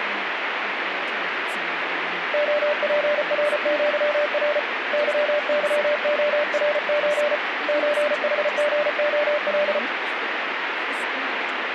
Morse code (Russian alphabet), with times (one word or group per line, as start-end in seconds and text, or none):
2.3-4.6 ОПРЪР
4.9-7.4 ЫЫОРЧ
7.7-9.8 ЧХГОЛ